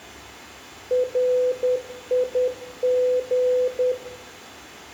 Morse code, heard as a keyed tone, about 10 wpm, 500 Hz, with room echo. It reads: RIG